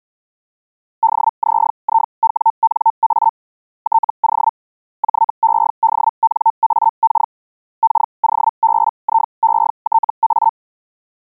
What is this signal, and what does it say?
Hellschreiber (Feld-Hell, 122.5 baud), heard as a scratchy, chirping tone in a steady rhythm, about 900 Hz. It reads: DZIWNA TO JEDNAK KOBIETA